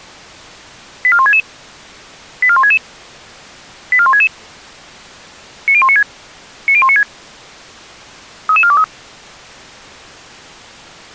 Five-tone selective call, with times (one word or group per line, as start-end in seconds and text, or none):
1.0-1.4 84166
2.4-2.8 84166
3.9-4.3 84166
5.7-6.0 90196
6.7-7.0 90196
8.5-8.8 33423